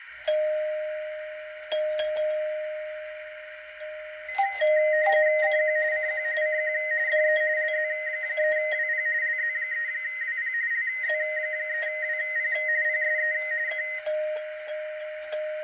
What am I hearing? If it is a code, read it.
RTTY (45.45 baud, 170 Hz shift), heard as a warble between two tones, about 1950 Hz centre, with radio static, fading and a narrow filter. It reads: CQ CQ CQ DE LZ3WP LZ3WP LZ3WP PSE K